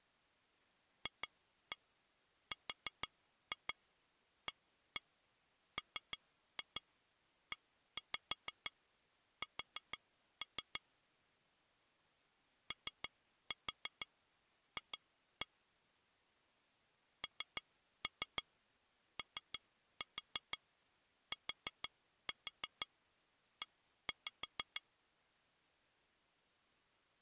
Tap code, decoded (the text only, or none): FRAMES OF NOTE